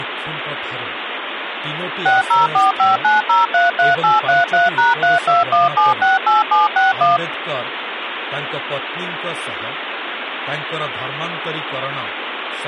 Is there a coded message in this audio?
Yes: DTMF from 2.1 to 7.2 s, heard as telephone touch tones, dialled by machine, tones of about 160 ms, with phone line noise and speech in Odia. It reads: 60459033833#321768761